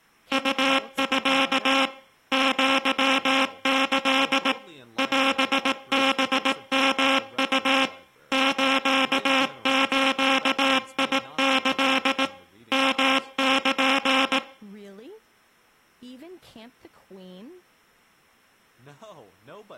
Morse code (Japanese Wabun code), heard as a buzzer, machine-sent, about 18 wpm, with room echo. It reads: ウミ アキ オハヨウ スズキ ヨル